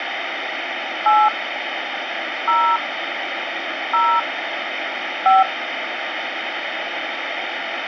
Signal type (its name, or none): DTMF